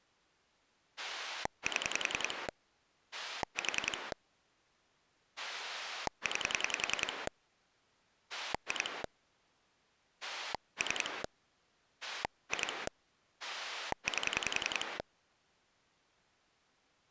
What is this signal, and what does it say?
Pulse dialling, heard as a rotary dial, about 10 pulses a second. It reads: 7 4 9 2 3 2 8